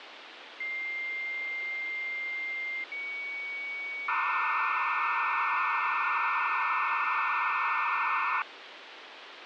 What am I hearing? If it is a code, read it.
Dial-up modem handshake (low-speed, two carriers), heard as two whistles, then hiss, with phone line noise.